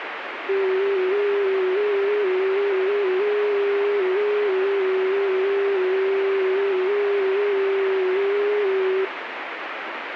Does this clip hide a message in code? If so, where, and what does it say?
Yes: FT8 (one signal) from 0.5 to 9.0 s, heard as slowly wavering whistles, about 6.25 baud, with radio static.